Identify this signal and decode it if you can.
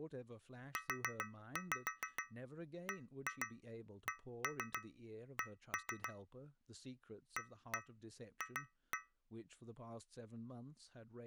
Tap code, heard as taps on a metal pipe, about 6 knocks a second, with speech in English. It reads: UBCC AF